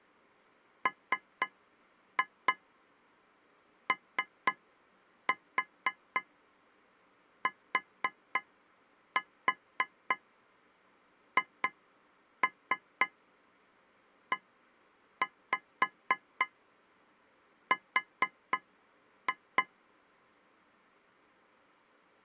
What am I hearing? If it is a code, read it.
Tap code, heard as taps on a metal pipe, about 4 knocks a second. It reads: MOTHER